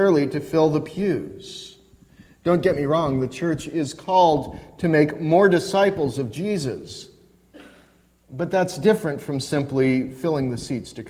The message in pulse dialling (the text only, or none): none